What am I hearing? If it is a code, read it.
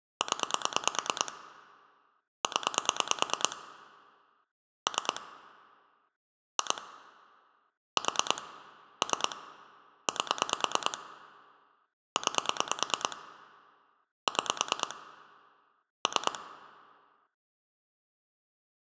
Pulse dialling, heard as clicks on a phone line, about 9 pulses a second. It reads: 0 0 3 2 4 3 8 9 6 3